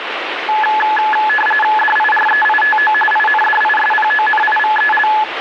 RTTY (45.45 baud, 850 Hz shift), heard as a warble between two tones, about 1280 Hz centre, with radio static. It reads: DIREITO INDISPONIVEL